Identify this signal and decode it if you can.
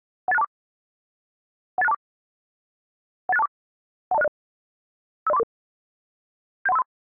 Five-tone selective call (EIA), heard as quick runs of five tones, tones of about 30 ms. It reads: 18624 18624 18624 12060 50344 71353